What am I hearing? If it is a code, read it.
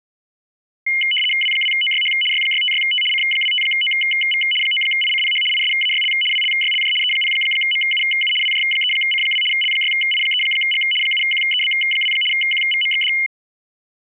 RTTY (75 baud, 850 Hz shift), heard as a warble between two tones, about 2550 Hz centre. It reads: W2OYH Y656T C25OV 9ICPH ISAYL WLYLJ E0MUU WJ3C2 L6I3G 7QEB2 QVMXD